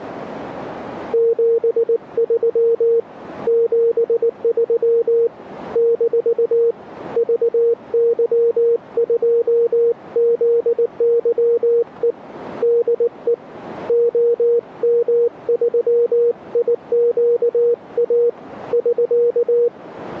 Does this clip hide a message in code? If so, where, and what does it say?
Yes: Morse code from 1.1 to 19.7 s, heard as a keyed tone, hand-sent with a paddle, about 19 wpm, 470 Hz. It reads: 73 73 - VY2ZYE DE OM3IQA <SK>